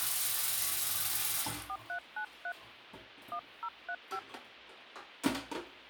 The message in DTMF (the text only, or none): 4393 1035